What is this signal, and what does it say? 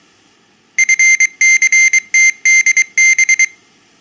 Morse code, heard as a high beeper, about 23 wpm, 2100 Hz. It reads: FCTDB